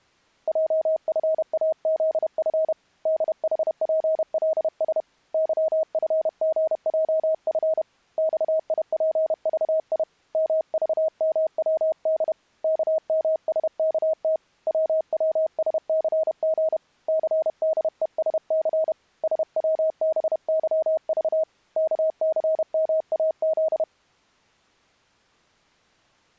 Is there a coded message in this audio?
Yes: Morse code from 0.4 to 23.9 s, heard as a keyed tone, hand-sent with a paddle, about 31 wpm, 630 Hz. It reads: JFAZF DHPLS YFGJF XIPVI MVMWD KMSKT WWSCG CDESC SWBYV KCMAZ